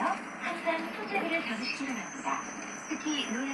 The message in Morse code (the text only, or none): none